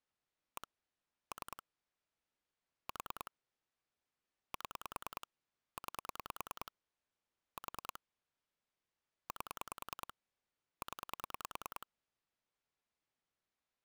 Pulse dialling, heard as clicks on a phone line, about 10 pulses a second. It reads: 1 3 4 7 9 4 8 0